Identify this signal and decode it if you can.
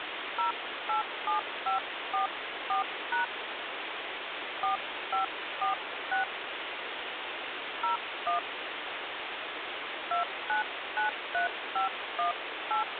DTMF, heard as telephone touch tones, dialled by hand, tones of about 120 ms, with phone line noise. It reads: 087544# 4546 01 2993518